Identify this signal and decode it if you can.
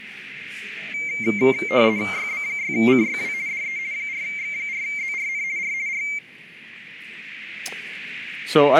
RTTY (50 baud, 170 Hz shift), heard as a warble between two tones, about 2200 Hz centre, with radio static and a narrow filter. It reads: YB6CYW DE 4X4ZRN R R